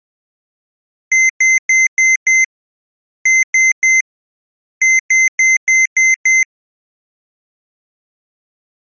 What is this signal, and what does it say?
Beep code, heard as beeps from a small speaker, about 2050 Hz. 5-3-6.